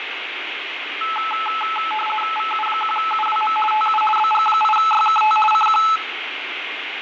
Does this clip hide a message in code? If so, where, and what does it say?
Yes: RTTY (50 baud, 450 Hz shift) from 1.0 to 6.0 s, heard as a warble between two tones, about 1080 Hz centre, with radio static, fading and room echo. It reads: VU1UWM TU BG8YKT CQ